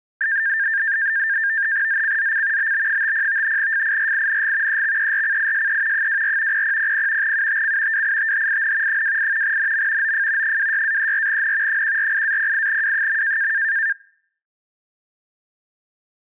NAVTEX (SITOR-B), 100 baud, 170 Hz shift, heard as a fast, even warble, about 1700 Hz centre. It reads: ZCZC BB50 FIRING EXERCISE 24 0000 UTC WITHIN 28 NM OF 26-34N 148-08W.